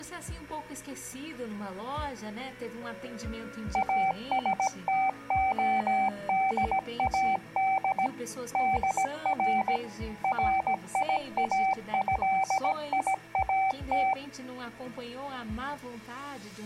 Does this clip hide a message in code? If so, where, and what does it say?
Yes: Morse code (Persian alphabet) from 3.7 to 14.2 s, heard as a keyed tone, machine-sent, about 17 wpm, 770 Hz. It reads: استعداد در ریاضیات